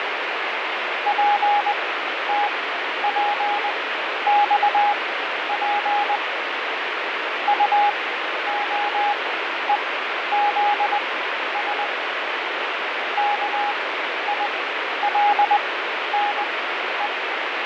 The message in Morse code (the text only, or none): PTPXP UOEZS KILNE